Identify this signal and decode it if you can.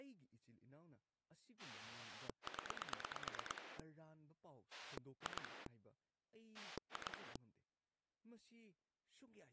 Pulse dialling, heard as a rotary dial, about 9 pulses a second, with speech in Manipuri. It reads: 0 2 2